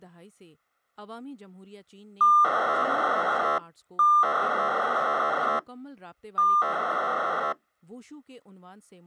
POCSAG pager data (2400 baud), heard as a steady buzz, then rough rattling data, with speech in Urdu.